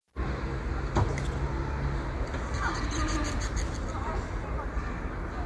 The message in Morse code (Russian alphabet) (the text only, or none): none